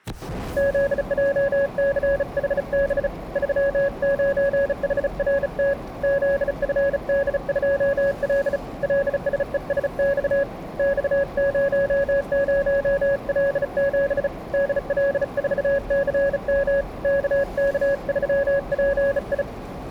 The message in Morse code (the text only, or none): ZJCHB 39HRT ZFD2L LSESX X00L7 DL4CM KK3PI